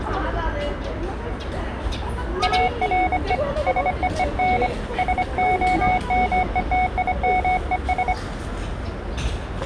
Morse code, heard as a keyed tone, hand-sent with a bug key, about 25 wpm, 740 Hz, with the noise of a residential street. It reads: ARE SEEN SOMETIMES